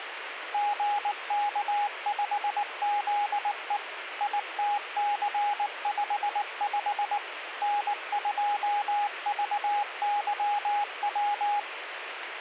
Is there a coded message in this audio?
Yes: Morse code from 0.5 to 11.7 s, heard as a keyed tone, machine-sent, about 19 wpm, 820 Hz, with radio static. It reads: GK5ZE ITC55 N2VYW